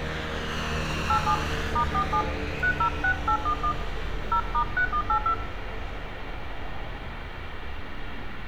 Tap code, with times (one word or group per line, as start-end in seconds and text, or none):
none